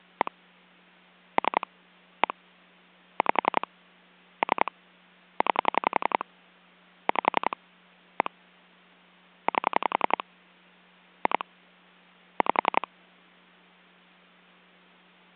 Pulse dialling, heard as clicks on a phone line, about 11 pulses a second. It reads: 1 3 1 5 3 9 5 1 8 2 5